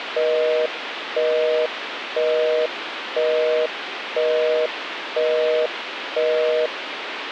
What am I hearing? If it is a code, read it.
Telephone call progress tone (North American plan), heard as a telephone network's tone, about 480, 620 Hz, 0.5 s on and 0.5 s off, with phone line noise. Busy tone.